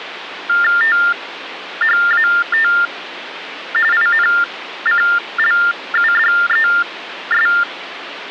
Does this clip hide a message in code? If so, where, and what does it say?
Yes: TTY/TDD text telephone tones (45.45 baud Baudot) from 0.5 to 7.6 s, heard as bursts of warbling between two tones, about 400 Hz shift, 1600 Hz centre, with phone line noise. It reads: THAT INCLUDES